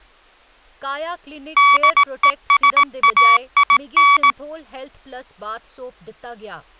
Morse code, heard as electronic beeps, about 18 wpm, 1140 Hz, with speech in Dogri. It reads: DESAIN